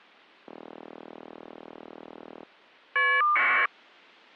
Caller ID data burst, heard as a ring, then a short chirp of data, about 1200 baud.